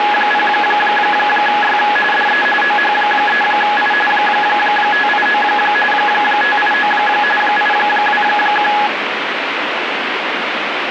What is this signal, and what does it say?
RTTY (45.45 baud, 850 Hz shift), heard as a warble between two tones, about 1260 Hz centre, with radio static. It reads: … DE OH3I 589 589 821